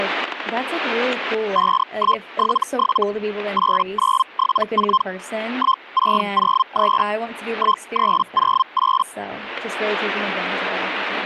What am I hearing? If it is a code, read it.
Hellschreiber (Feld-Hell, 122.5 baud), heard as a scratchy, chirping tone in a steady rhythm, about 1050 Hz, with static crashes and speech in English. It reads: 5177 8974 1603 1308